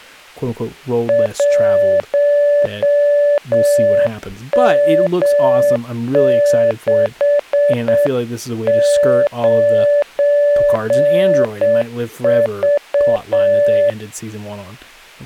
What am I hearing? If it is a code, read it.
Morse code, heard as a keyed tone, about 7 wpm, 580 Hz, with speech in English. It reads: 1M69V